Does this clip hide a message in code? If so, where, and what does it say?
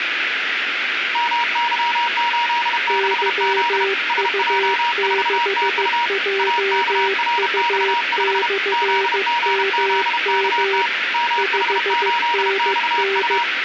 Yes: Morse code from 1.1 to 13.5 s, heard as two keyed tones, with radio static. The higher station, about 32 wpm, 950 Hz: MY86Z SJ4TU AKRX5 ZGZKT MH8XU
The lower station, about 15 wpm, 390 Hz: YU6JU/MM 5NN